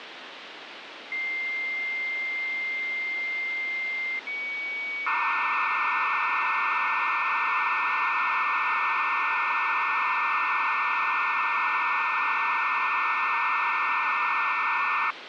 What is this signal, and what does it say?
Dial-up modem handshake (low-speed, two carriers), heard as two whistles, then hiss, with phone line noise.